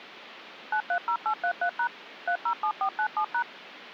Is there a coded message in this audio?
Yes: DTMF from 0.7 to 3.4 s, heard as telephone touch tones, dialled by machine, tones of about 80 ms, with phone line noise. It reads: 930833# 307497#